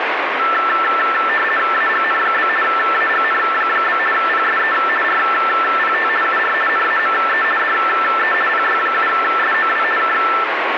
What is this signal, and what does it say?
RTTY (50 baud, 450 Hz shift), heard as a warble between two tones, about 1550 Hz centre, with radio static. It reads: AGN? AGN? PSE RPT UR NAME DE PY7SOW K